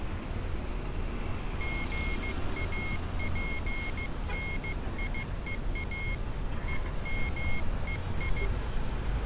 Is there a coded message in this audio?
Yes: Morse code (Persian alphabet) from 1.5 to 8.5 s, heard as a high beeper, hand-sent with a paddle, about 15 wpm, 2150 Hz, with street noise. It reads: ژاپنیها همهی